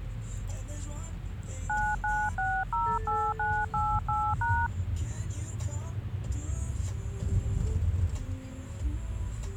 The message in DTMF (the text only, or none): 99608988#